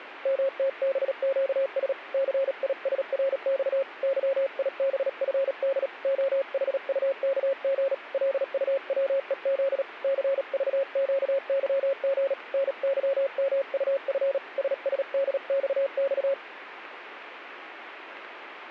Morse code, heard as a keyed tone, hand-sent with a paddle, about 37 wpm, 540 Hz. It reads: MTBQS CISRX YIBFD OHUKG LUWEZ CVQYG NYMUF SSDXX